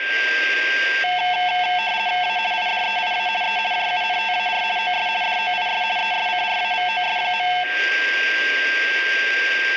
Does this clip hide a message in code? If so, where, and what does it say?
Yes: RTTY (50 baud, 170 Hz shift) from 1.0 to 7.6 s, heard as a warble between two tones, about 810 Hz centre, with a steady whistle near 1590 Hz and room echo. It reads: A IDEIA E JUNTAR OS DOIS ESCRAVOS.